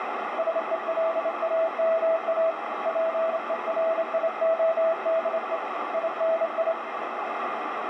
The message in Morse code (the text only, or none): SELAMA PERIODE INI